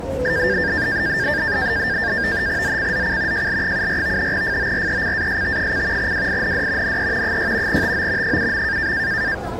NAVTEX (SITOR-B), 100 baud, 170 Hz shift, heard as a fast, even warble, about 1700 Hz centre, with the noise of a crowd indoors. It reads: ZCZC JL74 FORECAST: WIND NE 6 TO 7.